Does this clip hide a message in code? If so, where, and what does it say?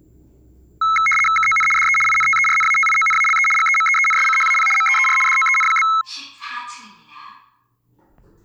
Yes: RTTY (75 baud, 850 Hz shift) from 0.8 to 6.0 s, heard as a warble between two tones, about 1750 Hz centre, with the noise inside a lift. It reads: KON DE INTERNATIONALE GEMEENSCHAP MEER DOEN?